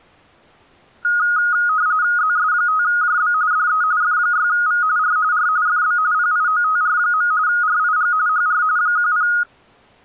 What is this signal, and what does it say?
RTTY (45.45 baud, 170 Hz shift), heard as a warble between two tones, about 1350 Hz centre. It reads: ZS5JB DE F6V R R FB PIOTR. RIG HR 10